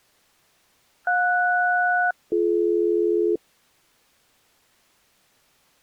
Aircraft SELCAL, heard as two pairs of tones. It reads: JS-BD